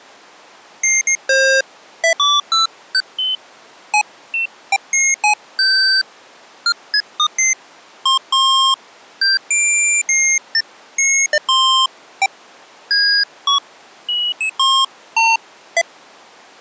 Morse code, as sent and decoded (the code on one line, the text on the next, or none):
none